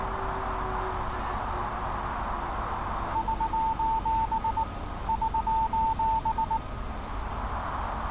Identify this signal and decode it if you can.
Morse code, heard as a keyed tone, hand-sent with a paddle, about 19 wpm, 890 Hz, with radio static, a narrow filter and street noise. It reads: <SOS> <SOS>